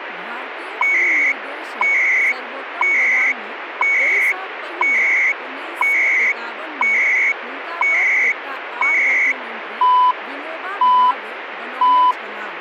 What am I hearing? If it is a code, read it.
Radio time signal (CHU, Canada), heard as beeps and data bursts, one a second, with radio static and speech in Maithili.